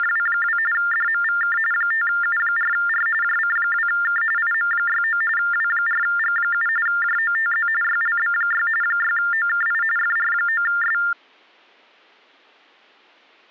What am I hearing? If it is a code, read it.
TTY/TDD text telephone tones (45.45 baud Baudot), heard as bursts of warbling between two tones, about 400 Hz shift, 1600 Hz centre. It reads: … DMVK 5U4R JC2K IM69 W4G7 JOTZ YLB6 6OKI FR9S